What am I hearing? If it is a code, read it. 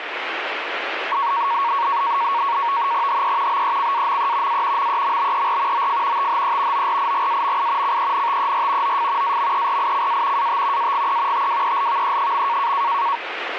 NAVTEX (SITOR-B), 100 baud, 170 Hz shift, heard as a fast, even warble, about 1020 Hz centre, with radio static. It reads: HE BECAME A MEMBER OF THE ORIGAMI CENTER OF AMERICA AT AGE TWELVE.